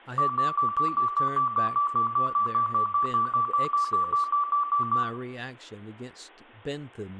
Evenly repeated beeps, with room echo and speech in English. There is no code.